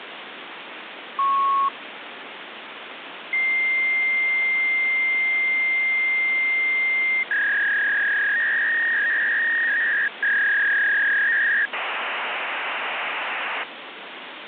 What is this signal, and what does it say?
Fax machine handshake, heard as a beep, a long tone, a warble and hiss, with phone line noise.